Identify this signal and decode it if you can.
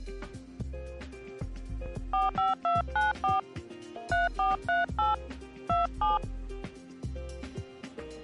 DTMF, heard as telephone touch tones, dialled by hand, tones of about 160 ms. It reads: 45294 3438 27